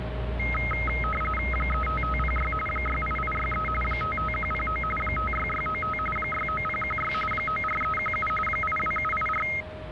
RTTY (45.45 baud, 850 Hz shift), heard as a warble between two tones, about 1700 Hz centre, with a steady whistle near 620 Hz and the noise of a residential street. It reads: 35506 68863 55109 56695 69016 94317 82784